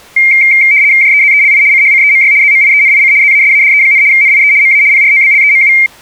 RTTY (75 baud, 170 Hz shift), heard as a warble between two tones, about 2200 Hz centre. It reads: JEZELI CHCEMY ZMIENIC ZASADE, NIE MA PROBLEMU